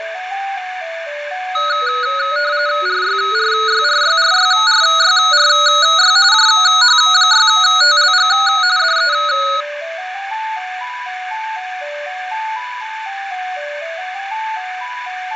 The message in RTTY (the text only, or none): RYRYRYRYRYRY JH6TLG DE